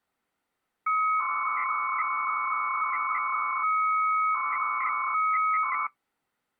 300-baud modem data (Bell 103 tones), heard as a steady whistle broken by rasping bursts, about 300 baud, 200 Hz shift.